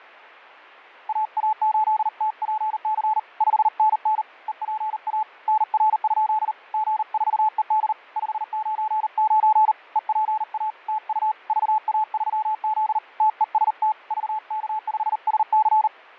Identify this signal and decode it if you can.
Morse code, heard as a keyed tone, hand-sent with a paddle, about 39 wpm, 860 Hz, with fading. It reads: AA8TPC 5NN EPA NR? G4ED 599 EPA TU VA3Z TEST VK5SC